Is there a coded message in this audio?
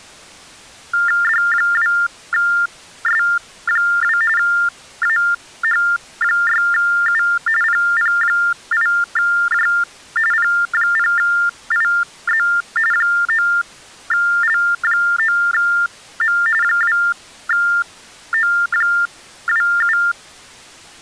Yes: TTY/TDD text telephone tones (45.45 baud Baudot) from 0.9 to 20.1 s, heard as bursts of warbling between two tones, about 400 Hz shift, 1600 Hz centre. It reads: D2S2 AH6U PP8J P0IZ 9L9M 2O27